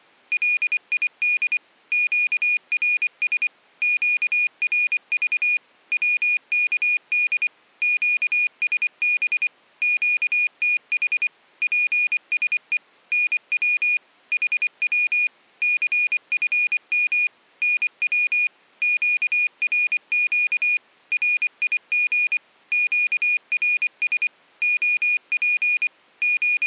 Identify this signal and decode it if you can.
Morse code, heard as a high beeper, machine-sent, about 24 wpm, 2450 Hz. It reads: LID QRS QRV WKD QSB QTH PSE NW HW CFM NW QRQ RIG QRS OP …